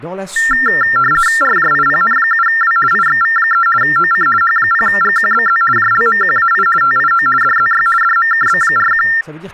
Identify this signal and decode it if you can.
RTTY (50 baud, 450 Hz shift), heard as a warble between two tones, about 1600 Hz centre, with speech in French. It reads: RJIPN7W IXV3 OC H0GQBZ JLMQAI TIO DZY DMKB41